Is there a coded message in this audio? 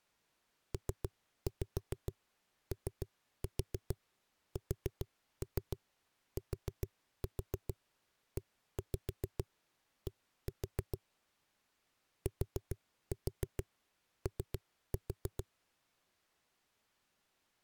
Yes: tap code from 0.7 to 15.5 s, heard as knocks on a wall, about 7 knocks a second. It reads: POSTED TO